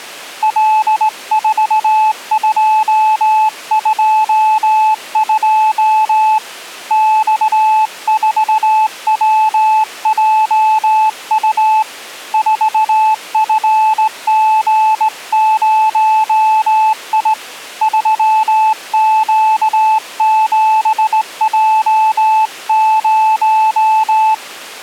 Morse code, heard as a keyed tone, hand-sent with a straight key, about 18 wpm, 870 Hz. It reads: L4222 X4WJU 4FG0I 3Q7J0